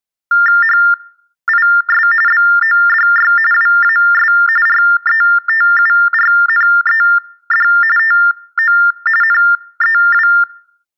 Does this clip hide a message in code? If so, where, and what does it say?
Yes: TTY/TDD text telephone tones (45.45 baud Baudot) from 0.3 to 10.4 s, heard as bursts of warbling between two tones, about 400 Hz shift, 1600 Hz centre. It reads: HIS BODY WAS RETURNED TO NEW